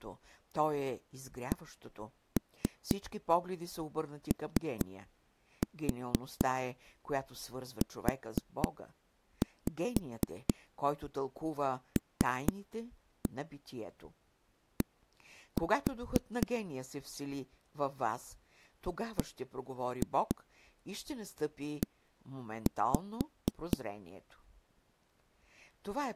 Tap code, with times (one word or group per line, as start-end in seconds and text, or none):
1.5-16.5 COULD
19.2-23.8 BE